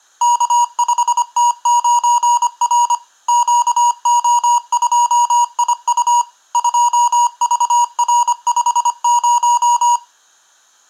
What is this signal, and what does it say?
Morse code, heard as electronic beeps, machine-sent, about 25 wpm, 960 Hz, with room echo. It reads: K5T9R QO2IU 2VR50